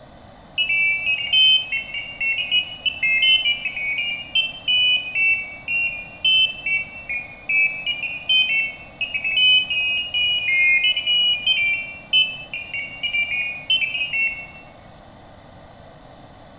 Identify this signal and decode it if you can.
Pairs of high tones at irregular times, with room echo. There is no code.